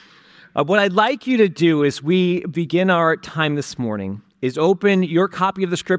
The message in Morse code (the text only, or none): none